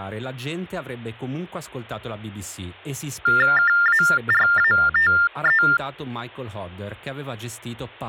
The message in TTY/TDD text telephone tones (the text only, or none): KARATE